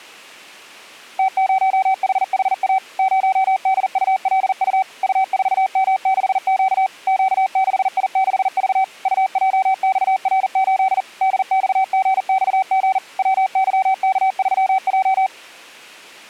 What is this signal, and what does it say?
Morse code, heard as a keyed tone, machine-sent, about 40 wpm, 760 Hz. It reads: T0HHA 0DULU U4M6Q Q6I6V UJXR8 DXGXG WYK3J